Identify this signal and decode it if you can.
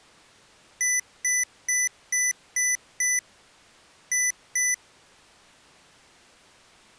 Beep code, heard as beeps from a small speaker, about 2000 Hz. 6-2.